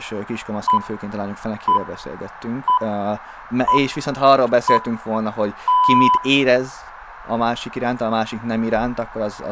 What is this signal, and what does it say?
Radio time signal (six pips, as the Greenwich Time Signal), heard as pips, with room echo and speech in Hungarian.